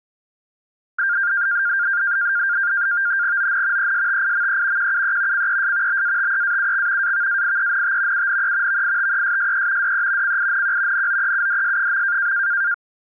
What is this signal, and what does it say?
NAVTEX (SITOR-B), 100 baud, 170 Hz shift, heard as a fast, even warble, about 1500 Hz centre. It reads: ON ESTIME QUE CES BATEAUX AVAIENT UNE VITESSE DE CINQ NOEUDS.